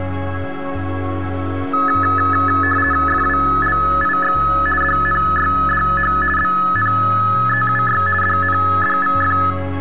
RTTY (50 baud, 450 Hz shift), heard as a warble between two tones, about 1500 Hz centre. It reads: FWLIX DNYDH BNEUY DNDVF